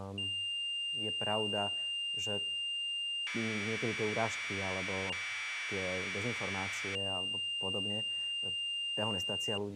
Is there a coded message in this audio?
Yes: Commodore tape loading (standard loader) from 0.2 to 9.6 s, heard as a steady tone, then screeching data, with speech in Slovak.